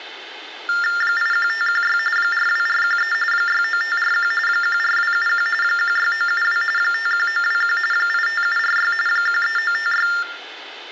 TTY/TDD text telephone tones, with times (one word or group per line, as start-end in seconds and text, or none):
1.0-2.0 81516
2.2-3.1 42413
3.3-4.3 69541
4.5-5.5 14271
5.6-6.6 16972
6.8-7.8 51921
7.9-8.9 85746
9.1-10.1 13956